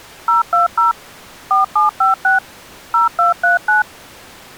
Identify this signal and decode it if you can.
DTMF, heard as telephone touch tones, dialled by machine, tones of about 140 ms. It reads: 020 4756 0239